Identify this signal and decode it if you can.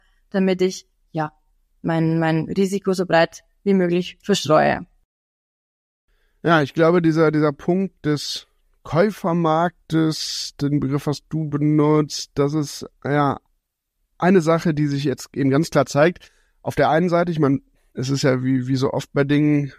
Speech in German. There is no code.